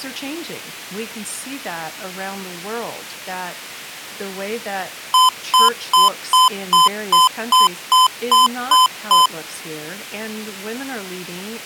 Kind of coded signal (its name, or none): beep code